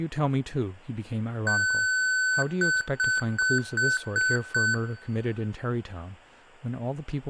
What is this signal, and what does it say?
Beep code, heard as beeps from a small speaker, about 1500 Hz, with room echo and speech in English. 1 long, 6 short.